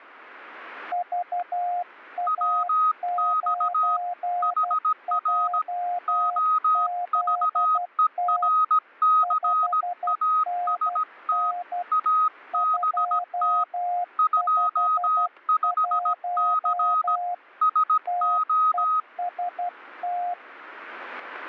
Morse code, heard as two keyed tones, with static crashes. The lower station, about 12 wpm, 710 Hz: VA9JZT 5NN 251 TEST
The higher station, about 17 wpm, 1260 Hz: WX HR OVERCAST ABT 25C SO